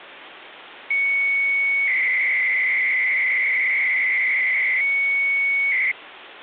300-baud modem data (Bell 103 tones), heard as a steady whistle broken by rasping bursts, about 300 baud, 200 Hz shift, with phone line noise.